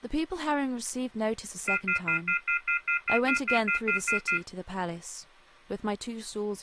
Telephone call progress tone (North American plan), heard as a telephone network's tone, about 1400, 2050, 2450, 2600 Hz, 0.1 s on and 0.1 s off, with speech in English. Off-hook warning tone.